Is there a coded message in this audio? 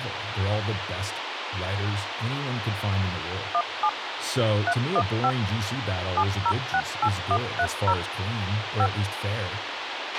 Yes: DTMF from 3.5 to 8.9 s, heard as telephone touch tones, dialled by machine, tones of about 60 ms, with radio hiss, a squelch burst at the end and speech in English. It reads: 17 315 7068130 5